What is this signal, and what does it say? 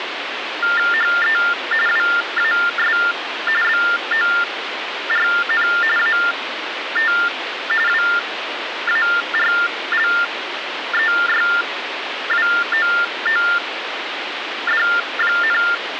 TTY/TDD text telephone tones (45.45 baud Baudot), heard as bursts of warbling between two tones, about 400 Hz shift, 1600 Hz centre, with phone line noise. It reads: HE WAS BORN AT WARLEYWOOD,